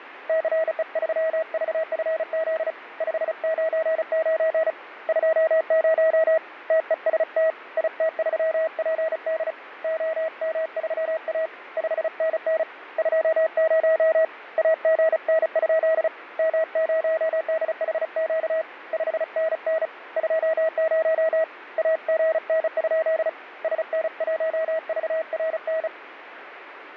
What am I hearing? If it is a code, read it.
Morse code, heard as a keyed tone, hand-sent with a bug key, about 35 wpm, 640 Hz, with radio static. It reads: CE3VFZ 599 20 TEST IT3PD OM3A 5NN 20 AGN? M0DHQ 5NN 20 AGN? SN1VRN